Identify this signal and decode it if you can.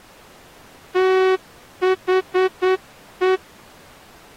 Morse code, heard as a horn, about 9 wpm. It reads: THE